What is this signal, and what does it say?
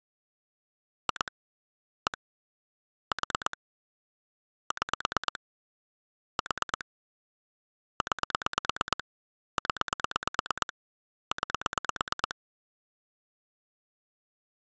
Pulse dialling, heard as clicks on a phone line, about 9 pulses a second. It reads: 2 1 4 6 4 9 0 9